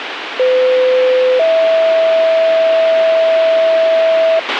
Two-tone page, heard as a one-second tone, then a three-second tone, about 510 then 650 Hz, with radio hiss and a squelch burst at the end.